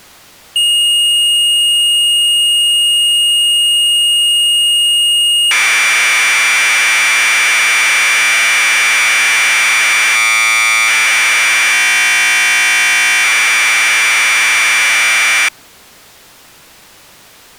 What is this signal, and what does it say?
Commodore tape loading (standard loader), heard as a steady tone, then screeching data.